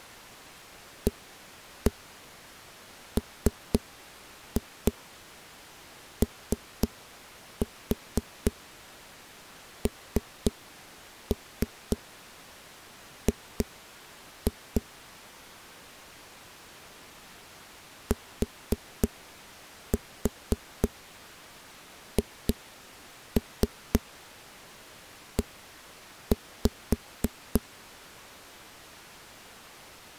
Tap code, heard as knocks on a wall, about 3 knocks a second. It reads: AMONG THE